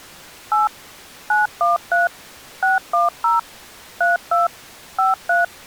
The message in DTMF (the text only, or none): 8 913 610 32 53